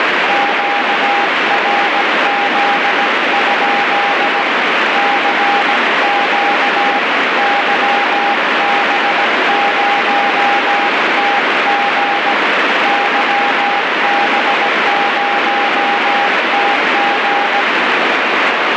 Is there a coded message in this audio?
Yes: Morse code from 0.2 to 17.7 s, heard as a keyed tone, hand-sent with a paddle, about 17 wpm, 810 Hz, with heavy radio static. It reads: QRZ? CQ YB0TG YB0TG